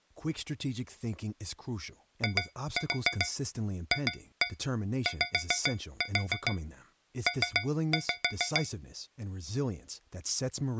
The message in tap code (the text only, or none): IFYP